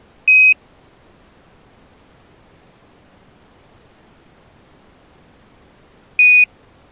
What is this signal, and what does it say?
Quindar tones, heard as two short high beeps.